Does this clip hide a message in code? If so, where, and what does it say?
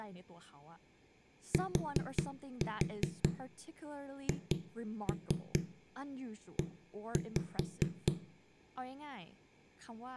Yes: tap code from 1.5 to 8.1 s, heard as knocks on a wall, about 4 knocks a second, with room echo and speech in English. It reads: THE